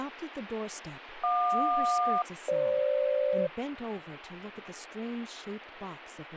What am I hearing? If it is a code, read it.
Aircraft SELCAL, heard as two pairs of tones, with radio static and speech in English. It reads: JQ-FG